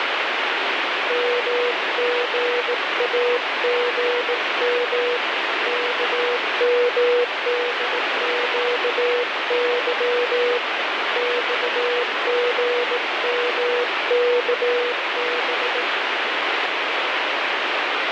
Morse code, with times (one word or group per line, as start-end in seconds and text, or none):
1.1-5.2 MGAGM
5.7-10.6 KMDQY
11.2-15.8 XGMKB